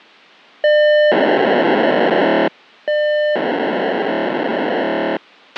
POCSAG pager data (1200 baud), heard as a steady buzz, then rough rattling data, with a squelch burst at the end.